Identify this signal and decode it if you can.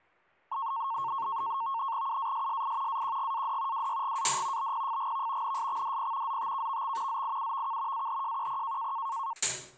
NAVTEX (SITOR-B), 100 baud, 170 Hz shift, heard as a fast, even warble, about 1000 Hz centre, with kitchen noise. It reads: UASSI AQGAD WYGAD BPFGV NSXDP ZTKVX ZIUVK AHJQP